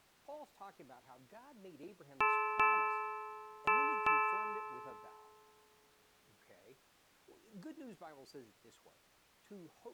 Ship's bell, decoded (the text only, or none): 4